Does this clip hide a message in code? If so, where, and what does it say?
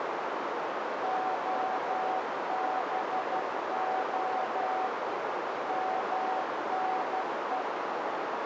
Yes: Morse code (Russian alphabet) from 1.0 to 7.7 s, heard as a keyed tone, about 12 wpm, 750 Hz, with heavy radio static and a narrow filter. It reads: ОБО МНЕ